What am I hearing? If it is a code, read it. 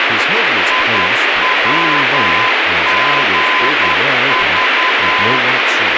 Morse code, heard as a keyed tone, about 10 wpm, 1020 Hz, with heavy radio static and speech in English. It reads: IWGV